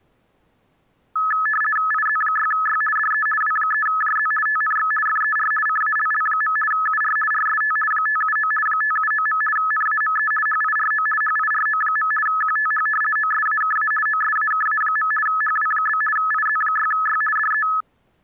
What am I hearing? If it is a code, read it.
RTTY (50 baud, 450 Hz shift), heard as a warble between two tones, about 1500 Hz centre. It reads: IZ6Y DE W3JZ TNX FER CALL. UR RST 579 579. NAME HIRO HIRO. QTH OSAKA OSAKA. HW? IZ6Y DE